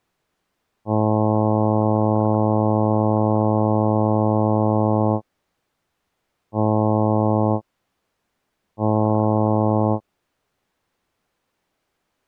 Ship horn signal, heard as a ship's horn, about 110 Hz. 1 long, 2 short. At sea: a vessel in fog that is sailing, fishing, towing or hampered.